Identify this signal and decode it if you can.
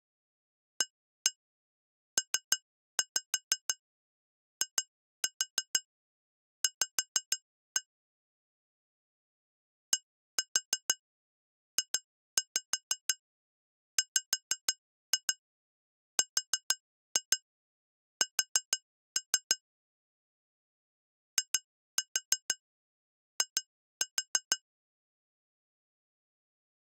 Tap code, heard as taps on glass, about 6 knocks a second. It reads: APIV DJWRS II